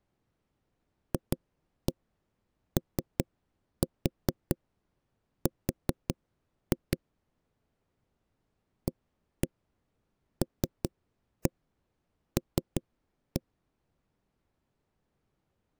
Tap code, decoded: FOR ALL

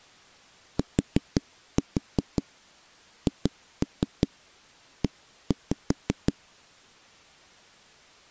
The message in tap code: THE

